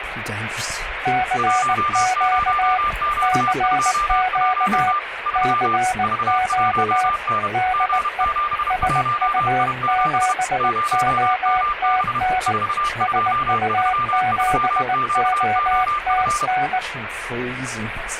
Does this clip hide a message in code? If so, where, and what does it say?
Yes: Morse code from 1.0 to 16.8 s, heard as two keyed tones, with radio static. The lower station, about 19 wpm, 740 Hz: CQ CQ CQ DE SU7OTN SU7OTN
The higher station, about 31 wpm, 1190 Hz: 10Q21 3 V1N G71I7 0MB 4233QOF